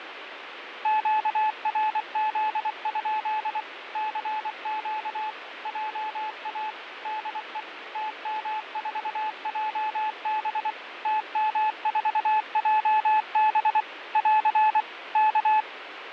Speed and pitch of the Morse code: 24 wpm, 860 Hz

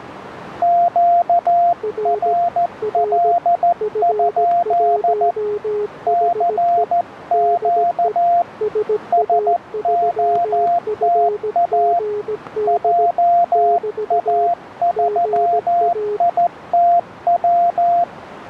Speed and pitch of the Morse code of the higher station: 14 wpm, 700 Hz

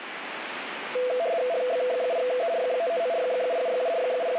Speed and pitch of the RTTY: 75 baud, 170 Hz shift, 590 Hz centre

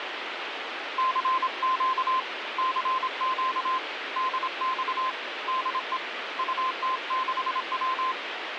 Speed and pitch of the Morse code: 26 wpm, 1040 Hz

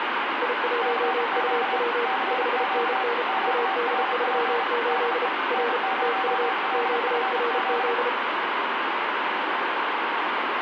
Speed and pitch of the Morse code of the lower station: 33 wpm, 470 Hz

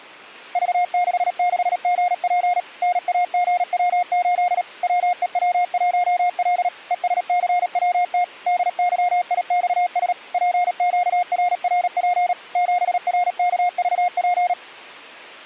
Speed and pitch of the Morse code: 37 wpm, 710 Hz

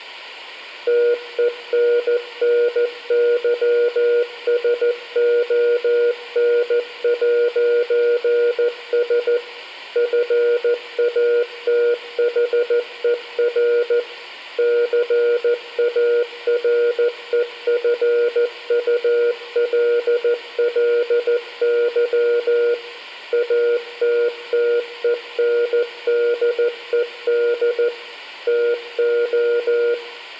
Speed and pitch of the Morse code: 14 wpm, 480 Hz

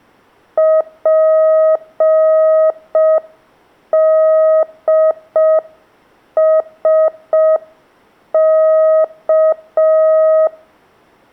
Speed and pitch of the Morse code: 5 wpm, 630 Hz

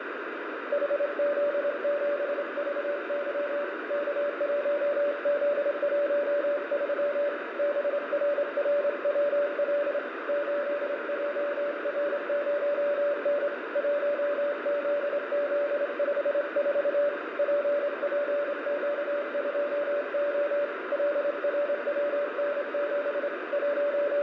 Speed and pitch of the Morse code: 27 wpm, 580 Hz

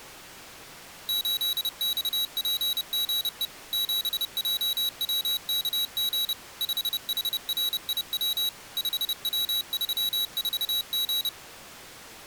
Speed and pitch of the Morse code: 30 wpm, 3900 Hz

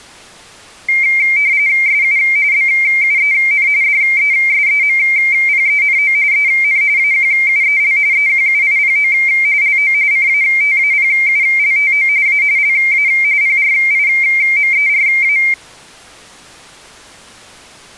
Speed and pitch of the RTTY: 45.45 baud, 170 Hz shift, 2200 Hz centre

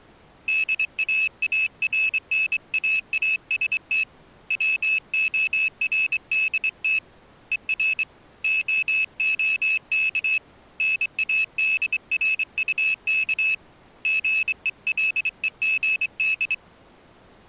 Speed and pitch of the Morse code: 24 wpm, 2600 Hz

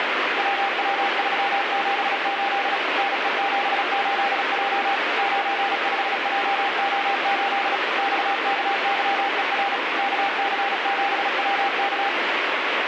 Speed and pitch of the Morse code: 36 wpm, 800 Hz

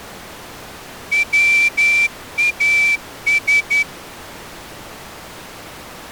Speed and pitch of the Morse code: 11 wpm

